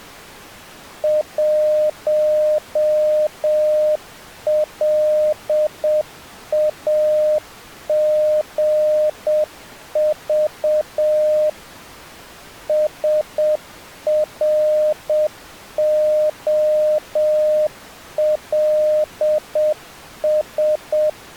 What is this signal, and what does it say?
Morse code, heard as a keyed tone, machine-sent, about 7 wpm, 610 Hz. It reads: 1LAGV SROLS